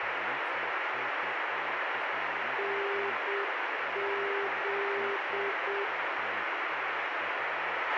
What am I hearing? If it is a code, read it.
Morse code, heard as a keyed tone, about 7 wpm, 400 Hz, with radio hiss, a squelch burst at the end and speech in Russian. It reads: NZ